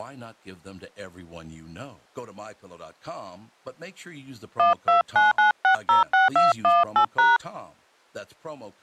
DTMF, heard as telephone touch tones, dialled by hand, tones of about 130 ms, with speech in English. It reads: 1299606218#